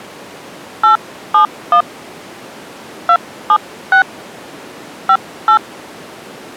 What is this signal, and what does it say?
DTMF, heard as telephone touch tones, dialled by hand, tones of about 90 ms. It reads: 871 276 58